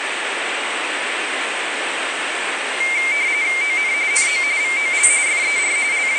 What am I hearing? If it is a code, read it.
RTTY (45.45 baud, 170 Hz shift), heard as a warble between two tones, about 2200 Hz centre, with radio static and the noise of a subway station. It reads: ON NO VOL FER …